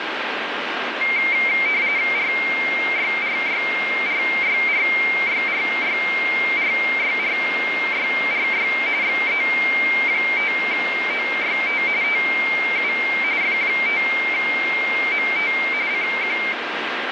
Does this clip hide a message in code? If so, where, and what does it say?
Yes: RTTY (45.45 baud, 170 Hz shift) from 1.0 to 16.5 s, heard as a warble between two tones, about 2200 Hz centre, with radio static. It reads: RYRYRYRYRYRYRYRY XE5OYT TU F5MT CQ